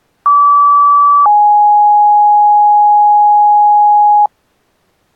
Two-tone page, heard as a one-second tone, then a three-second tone, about 1150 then 830 Hz.